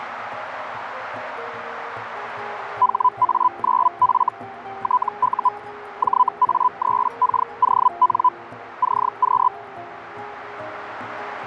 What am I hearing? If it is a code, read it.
Hellschreiber (Feld-Hell, 122.5 baud), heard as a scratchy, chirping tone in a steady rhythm, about 1000 Hz, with radio static. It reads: HA9F TU JA3KON CQ